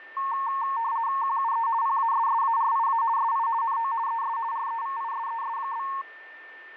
RTTY (50 baud, 170 Hz shift), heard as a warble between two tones, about 1000 Hz centre, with a steady whistle near 1790 Hz. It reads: QUE PASSARIA SI NO ES REVISES?